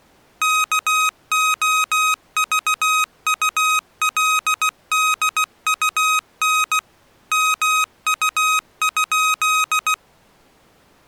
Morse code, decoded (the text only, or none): KOVULDUN MU?